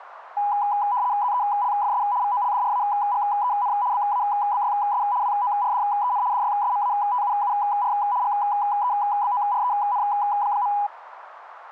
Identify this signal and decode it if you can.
RTTY (75 baud, 170 Hz shift), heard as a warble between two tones, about 900 Hz centre, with radio static. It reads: ZELFS VOLDRAGEN BABYS WORDEN DYSMATUUR GEBOREN.